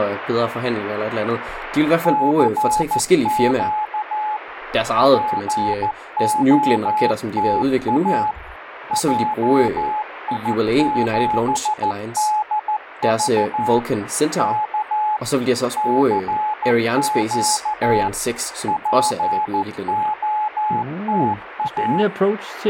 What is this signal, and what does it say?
Morse code, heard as a keyed tone, machine-sent, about 14 wpm, 850 Hz, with radio static and speech in Danish. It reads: CQ POTA JI7DV K CQ POTA